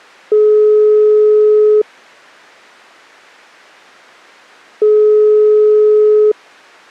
Telephone call progress tone (single-tone plan, as in most of Europe), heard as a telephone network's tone, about 420 Hz, 1.5 s on and 3 s off. Ringback tone.